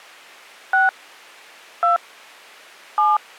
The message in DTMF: 6 2 7

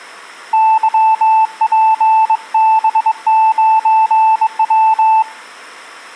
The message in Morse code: YPB9W

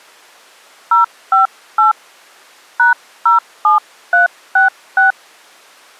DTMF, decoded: 058 #07366

